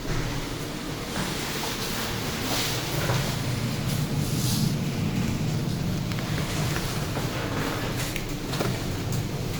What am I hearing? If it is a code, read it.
The noise inside a lift. There is no code.